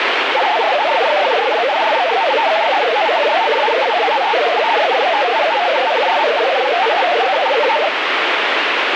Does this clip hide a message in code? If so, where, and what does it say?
Yes: multi-tone FSK (Olivia or MFSK type), about 500 Hz wide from 0.3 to 7.9 s, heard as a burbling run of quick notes, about 62.5 baud, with radio static.